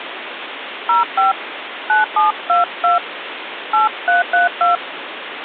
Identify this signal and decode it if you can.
DTMF, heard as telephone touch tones, dialled by hand, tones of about 140 ms, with phone line noise. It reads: 05 9722 8332